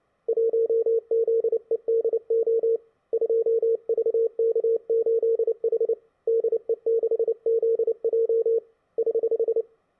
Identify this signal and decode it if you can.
Morse code, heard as a keyed tone, hand-sent with a paddle, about 29 wpm, 460 Hz. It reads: 1ZEDO 2VK8H DE6ZJ <HH>